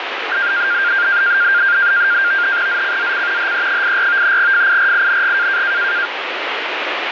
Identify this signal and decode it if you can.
NAVTEX (SITOR-B), 100 baud, 170 Hz shift, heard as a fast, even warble, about 1500 Hz centre, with radio static. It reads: ZCZC HE84 FIRING